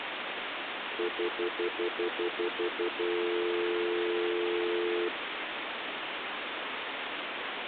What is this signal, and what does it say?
Telephone call progress tone (North American plan), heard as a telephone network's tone, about 350, 440 Hz, 0.1 s on and 0.1 s off, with phone line noise. Stutter dial tone.